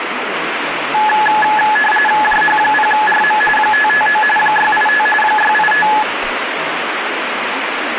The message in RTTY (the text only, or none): JH0RM 559 685 685